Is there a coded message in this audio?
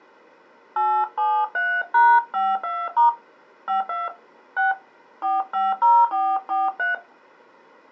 Yes: DTMF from 0.8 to 6.9 s, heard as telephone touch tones, dialled by hand, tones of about 220 ms. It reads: 873#52* 52 6 450443